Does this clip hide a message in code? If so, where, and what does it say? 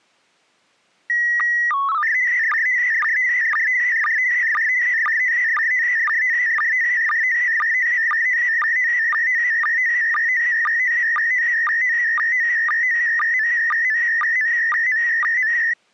Yes: SSTV (slow-scan television), PD 120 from 1.1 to 15.7 s, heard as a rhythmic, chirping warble.